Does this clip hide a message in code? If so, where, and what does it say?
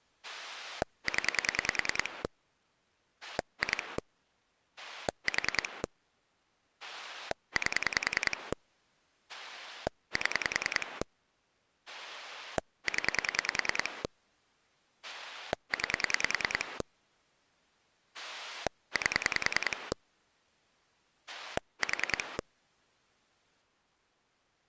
Yes: pulse dialling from 0.2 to 22.4 s, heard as a rotary dial, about 10 pulses a second. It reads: 0 2 4 8 7 0 9 8 4